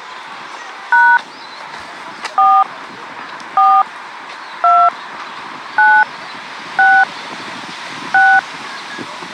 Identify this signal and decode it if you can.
DTMF, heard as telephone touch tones, dialled by hand, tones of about 250 ms, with the noise of a park. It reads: # 4 4 2 9 6 6